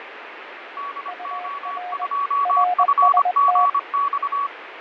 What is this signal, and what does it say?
Morse code, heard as two keyed tones, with radio static and fading. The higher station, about 25 wpm, 1130 Hz: DO2FGX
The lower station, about 21 wpm, 720 Hz: UR RST